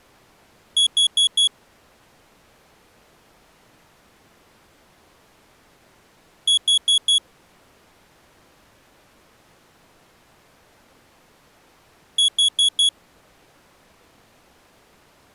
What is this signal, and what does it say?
Alarm pattern, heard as an alarm's beeps, played three times, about 3350 Hz. Temporal four. Carbon monoxide.